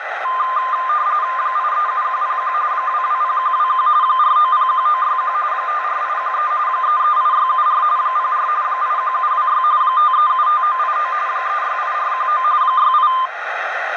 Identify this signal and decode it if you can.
RTTY (45.45 baud, 170 Hz shift), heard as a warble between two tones, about 1120 Hz centre, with radio static and a narrow filter. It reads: 837101 220121 4901961 54813 338674 04 81726 5375989 368419 68